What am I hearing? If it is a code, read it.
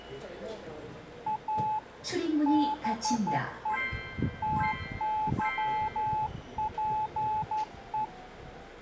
Morse code, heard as a keyed tone, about 12 wpm, 860 Hz, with the noise inside a subway train. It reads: A BE TYPE